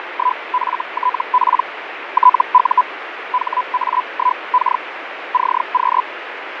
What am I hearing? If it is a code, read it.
Hellschreiber (Feld-Hell, 122.5 baud), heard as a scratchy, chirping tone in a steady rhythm, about 1000 Hz, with radio static and fading. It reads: … TU HA1K CQ